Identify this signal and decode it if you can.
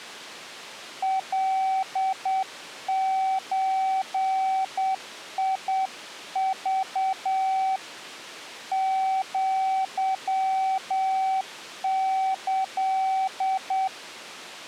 Morse code (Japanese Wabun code), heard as a keyed tone, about 8 wpm, 760 Hz. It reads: カゾク アキ